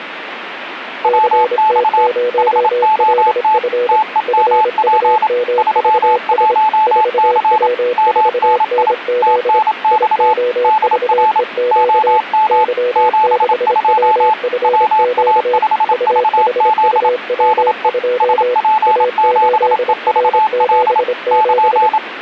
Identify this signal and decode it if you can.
Morse code, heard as two keyed tones, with radio static. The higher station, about 27 wpm, 870 Hz: WX HOT TEMP 31C MNI TNX DR OM 72 WA5VZ DE SP7EVL <KN>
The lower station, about 26 wpm, 490 Hz: CT0LF FUMVS 4W4NZ IOVEQ Y6WFQ UHUW2 A8R77